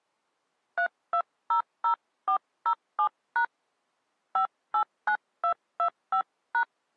DTMF, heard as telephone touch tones, dialled by hand, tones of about 90 ms. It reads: 3200407# 589225#